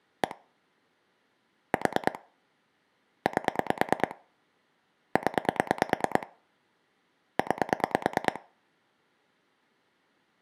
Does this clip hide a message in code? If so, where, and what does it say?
Yes: pulse dialling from 0.2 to 8.4 s, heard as clicks on a phone line, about 9 pulses a second. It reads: 1 4 8 0 9